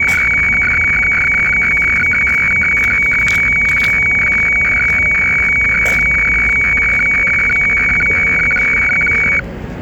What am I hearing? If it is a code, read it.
Weather fax (radiofax), 120 lines a minute, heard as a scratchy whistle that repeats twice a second, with street noise.